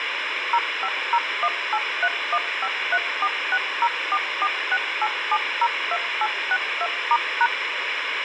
DTMF, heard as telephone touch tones, dialled by machine, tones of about 60 ms, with radio hiss. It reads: 0501831534604468702862*#